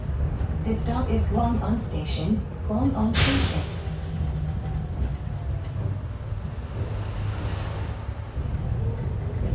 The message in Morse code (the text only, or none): none